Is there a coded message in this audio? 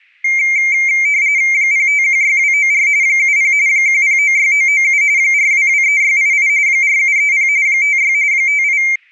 Yes: RTTY (45.45 baud, 170 Hz shift) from 0.2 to 9.0 s, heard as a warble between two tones, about 2200 Hz centre. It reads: 0516294 70 1096997 4223688 4730 56 58